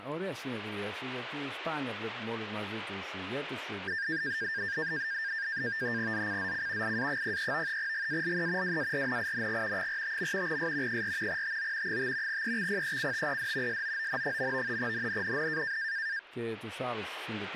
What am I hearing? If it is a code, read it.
NAVTEX (SITOR-B), 100 baud, 170 Hz shift, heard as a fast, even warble, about 1700 Hz centre, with radio static. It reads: ZCZC IA03 GALE WARNING 45. S 4 TO 5 EXPECTED SOON. NNNN